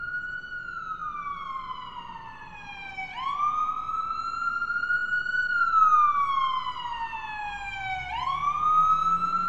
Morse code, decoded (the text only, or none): none